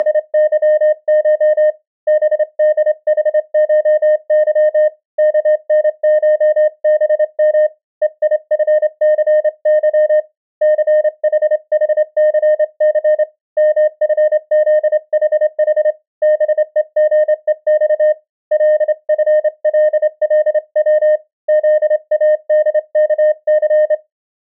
Morse code (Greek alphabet), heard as a keyed tone, hand-sent with a straight key, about 27 wpm, 610 Hz. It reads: … ΒΔΗΧΥ ΚΝΧΒΜ ΕΙΦΘΥ ΘΗΗΘΘ ΜΦΖΗΗ ΒΕΓΕΞ ΛΦΛΛΩ ΖΑΔΚΘ